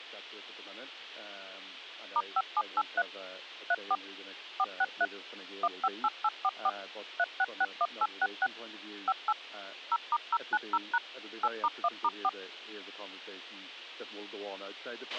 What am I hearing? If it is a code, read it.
DTMF, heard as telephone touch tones, dialled by machine, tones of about 50 ms, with a squelch burst at the end. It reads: *5783 34 463 158844 3661866 58 0*090# 8*1*4